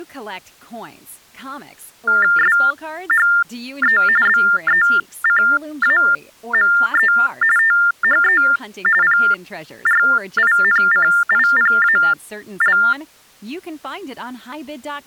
TTY/TDD text telephone tones (45.45 baud Baudot), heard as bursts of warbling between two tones, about 400 Hz shift, 1600 Hz centre, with speech in English. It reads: SHE BECAME THE PRINCIPAL